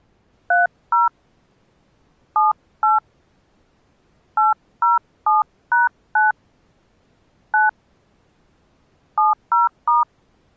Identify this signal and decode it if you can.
DTMF, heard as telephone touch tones, dialled by hand, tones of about 160 ms. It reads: 30 78 807#9 9 70*